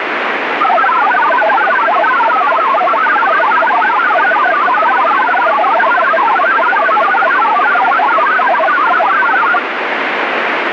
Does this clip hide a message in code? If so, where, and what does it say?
Yes: multi-tone FSK (Olivia or MFSK type), about 1000 Hz wide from 0.6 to 9.6 s, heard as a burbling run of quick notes, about 62.5 baud, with radio static.